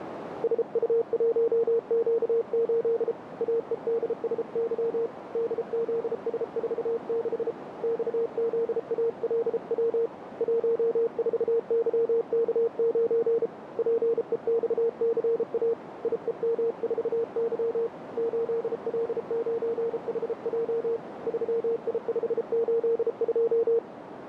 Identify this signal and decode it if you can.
Morse code, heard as a keyed tone, hand-sent with a paddle, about 33 wpm, 460 Hz, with radio static and a narrow filter. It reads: SU1Q8 AEDSY DZS46 XZALW 14YK9 PEXCA IEM4Y 8L9HJ 3I582